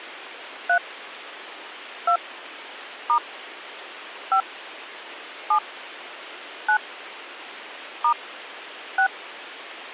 DTMF, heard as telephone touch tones, dialled by hand, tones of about 90 ms. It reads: 3 2 * 5 7 9 * 6